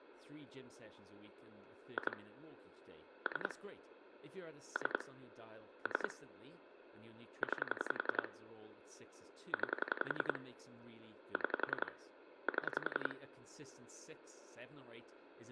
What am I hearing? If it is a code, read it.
Pulse dialling, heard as clicks on a phone line, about 11 pulses a second, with phone line noise and speech in English. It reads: 2 3 3 3 9 9 6 7